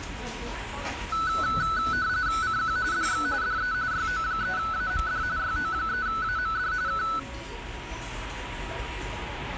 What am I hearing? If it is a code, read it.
RTTY (45.45 baud, 170 Hz shift), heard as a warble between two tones, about 1400 Hz centre, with radio static, a steady whistle near 960 Hz and the noise of a restaurant. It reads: CQ DX DE YO3AMD YO3AMD K